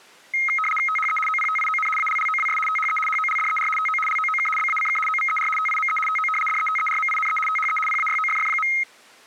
RTTY (75 baud, 850 Hz shift), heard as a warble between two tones, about 1700 Hz centre. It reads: THE OPTION ALLOWS THE HOLDER TO LOOK BACK OVER TIME TO DETERMINE THE PAYOFF.